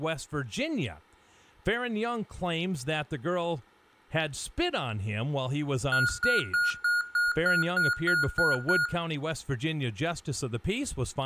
Beep code, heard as beeps from a small speaker, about 1440 Hz, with room echo and speech in English. 10 short. In AMI BIOS tables: CMOS shutdown register error.